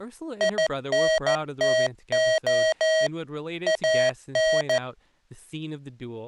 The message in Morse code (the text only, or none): INTO AN